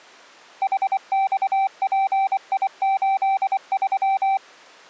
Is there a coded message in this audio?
Yes: Morse code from 0.6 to 4.4 s, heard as a keyed tone, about 24 wpm, 780 Hz. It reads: HXPI83